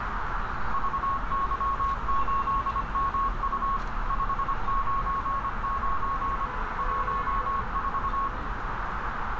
Morse code, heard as a keyed tone, machine-sent, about 25 wpm, 1100 Hz, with heavy radio static, a narrow filter and street noise. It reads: VY8MU 599 14